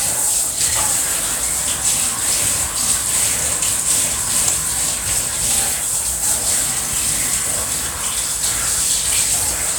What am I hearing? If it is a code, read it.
Kitchen noise. There is no code.